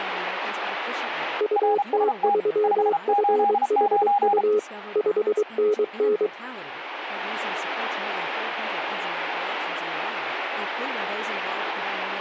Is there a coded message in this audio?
Yes: Morse code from 1.3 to 6.3 s, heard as two keyed tones, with speech in English. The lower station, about 23 wpm, 420 Hz: UT3FHU 5NN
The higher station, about 33 wpm, 810 Hz: RST 589